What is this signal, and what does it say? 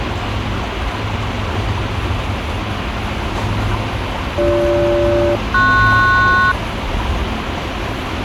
Aircraft SELCAL, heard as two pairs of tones, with radio hiss and the noise of a park. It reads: BG-PS